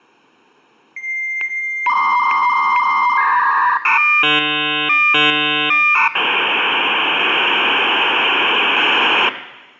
Dial-up modem handshake (V.34 or later), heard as a whistle, warbles, then hiss, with room echo.